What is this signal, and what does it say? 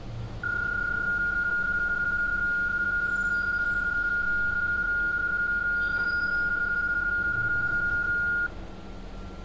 PSK31 (31.25 baud), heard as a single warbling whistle, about 1420 Hz, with street noise.